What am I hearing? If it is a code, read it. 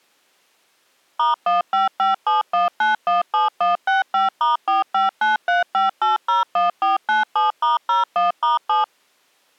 DTMF, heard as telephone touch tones, dialled by machine, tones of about 150 ms. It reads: *15571917165*45935801497*01*7